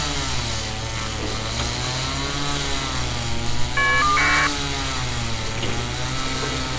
Caller ID data burst, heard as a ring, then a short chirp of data, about 1200 baud, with street noise.